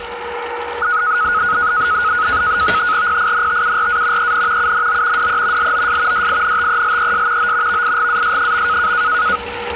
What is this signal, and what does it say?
NAVTEX (SITOR-B), 100 baud, 170 Hz shift, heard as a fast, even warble, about 1360 Hz centre, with radio static, a steady whistle near 480 Hz and kitchen noise. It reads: PINTURA EN UNO DE LOS DINTELES O VIGAS.